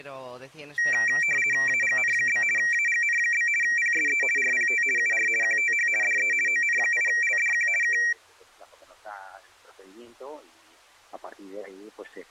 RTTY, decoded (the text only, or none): AGN? AGN? PSE RPT UR QTH DE ON8LDQ K